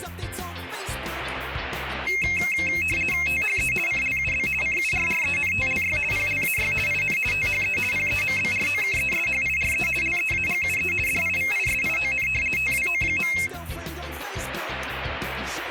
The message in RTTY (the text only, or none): THE CLUB CURRENTLY PLAY IN THE PEMBROKESHIRE LEAGUE DIVISION TWO.